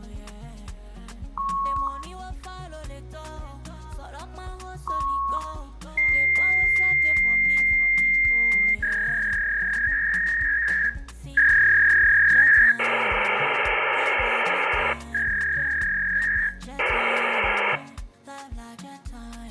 Fax machine handshake, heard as beeps, a long tone, a warble and hiss.